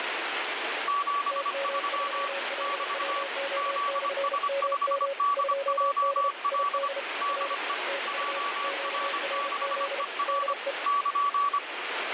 Morse code, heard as two keyed tones, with heavy radio static. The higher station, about 25 wpm, 1140 Hz: 73 <BT> ZS5DJL DE JR6ER <KN>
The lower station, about 33 wpm, 550 Hz: TM3LWO/MM 2D ID R TU QRZ DE